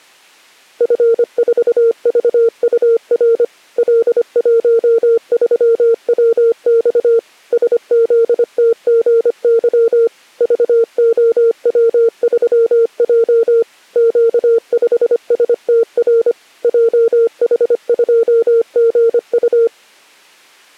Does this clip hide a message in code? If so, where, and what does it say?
Yes: Morse code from 0.7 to 19.7 s, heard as a keyed tone, machine-sent, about 25 wpm, 460 Hz. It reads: F4VUR L13WX SZTGY VOW3J Q5STR JH2GU